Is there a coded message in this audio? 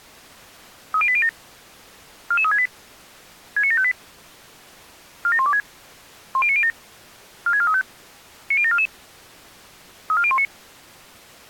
Yes: five-tone selective call (ZVEI) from 0.9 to 10.4 s, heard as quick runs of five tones, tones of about 70 ms. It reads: 30807 44368 69758 47126 10907 46435 90744 34019